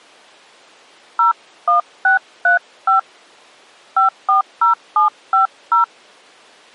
DTMF, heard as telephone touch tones, dialled by hand, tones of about 120 ms. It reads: 01635 540750